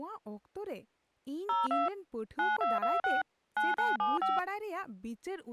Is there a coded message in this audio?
Yes: DTMF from 1.5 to 4.4 s, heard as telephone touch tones, dialled by machine, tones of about 180 ms, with speech in Santali. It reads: 02 9226 9975